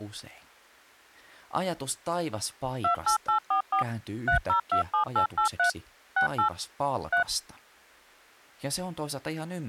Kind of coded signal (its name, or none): DTMF